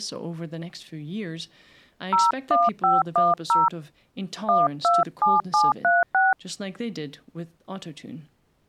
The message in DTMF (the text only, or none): 01510 127736